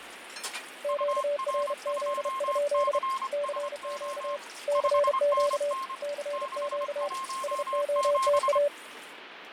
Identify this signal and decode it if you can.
Morse code, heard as two keyed tones, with radio static, fading and kitchen noise. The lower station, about 32 wpm, 580 Hz: QRZ? CQ CQ CQ SOTA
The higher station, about 25 wpm, 1060 Hz: UR2CSO 5NN 617